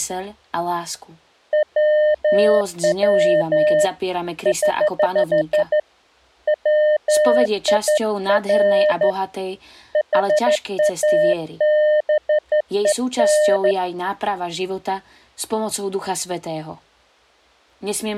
Morse code, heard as a keyed tone, hand-sent with a straight key, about 13 wpm, 610 Hz, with speech in Slovak. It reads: WW <HH> WIR HABEN